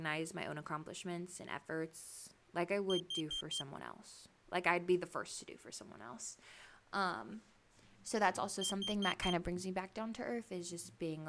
Alarm pattern, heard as an alarm's beeps, played twice, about 3150 Hz, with speech in English. Temporal four. Carbon monoxide.